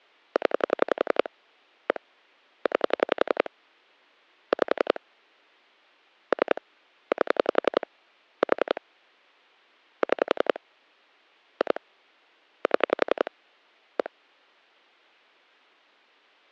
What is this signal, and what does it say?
Pulse dialling, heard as clicks on a phone line, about 11 pulses a second. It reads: 0 1 9 5 3 8 4 6 2 7 1